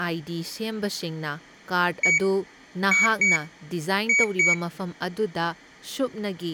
Beep code, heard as a piezo beeper, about 2250 Hz, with room echo and speech in Manipuri. 1-2-2. In Phoenix BIOS tables: DMA initialisation failure.